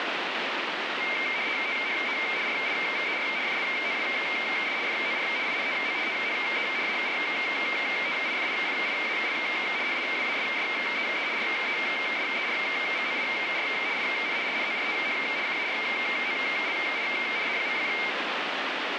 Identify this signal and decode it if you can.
RTTY (75 baud, 170 Hz shift), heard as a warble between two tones, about 2200 Hz centre, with radio static. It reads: THE RIVER FLOWS FOR INTO THE ARTIFICIAL HIWASSEE RESERVOIR IN NORTH CAROLINA.